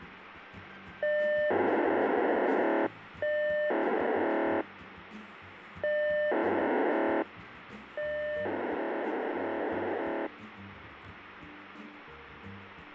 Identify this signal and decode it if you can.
POCSAG pager data (1200 baud), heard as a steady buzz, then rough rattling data, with radio hiss.